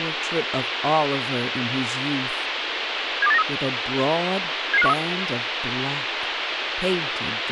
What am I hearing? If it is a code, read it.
Five-tone selective call (EEA), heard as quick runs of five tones, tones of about 40 ms, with radio hiss and speech in English. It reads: 72893 77513